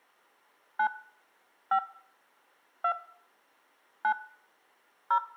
DTMF, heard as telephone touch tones, dialled by hand, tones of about 80 ms, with room echo. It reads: 9 5 2 9 0